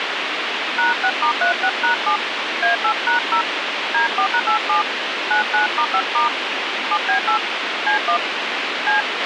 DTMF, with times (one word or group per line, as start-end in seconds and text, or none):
0.8-2.2 #6*36#7
2.6-3.4 A8#0
3.9-4.8 D4#87
5.3-6.3 99*5*
6.9-7.4 7B8
7.9-8.2 C1
8.9-9.0 C